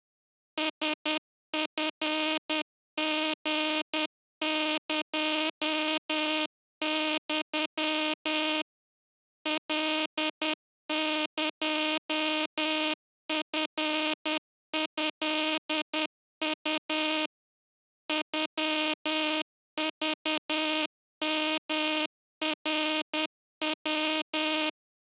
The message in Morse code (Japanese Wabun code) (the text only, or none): ラチリエユ カエチトウ ノクヨナヤ